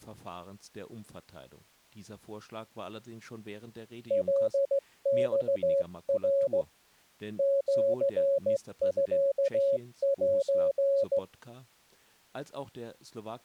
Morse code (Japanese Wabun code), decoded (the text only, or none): カマナ シミセ